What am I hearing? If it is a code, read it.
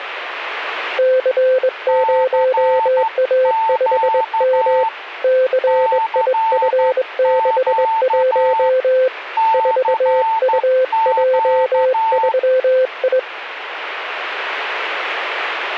Morse code, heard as two keyed tones. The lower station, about 22 wpm, 520 Hz: C0A5M CIF61 4UJ3I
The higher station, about 12 wpm, 890 Hz: CQ CQ CQ